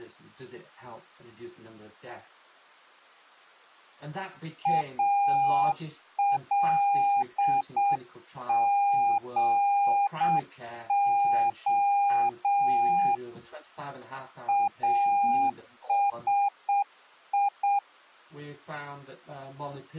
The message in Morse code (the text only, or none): ALGO ASI